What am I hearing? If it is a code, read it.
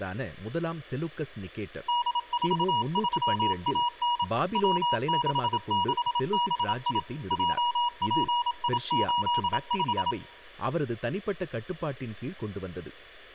Morse code, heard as a keyed tone, machine-sent, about 27 wpm, 960 Hz, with speech in Tamil. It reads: D43AN W66BI JPI85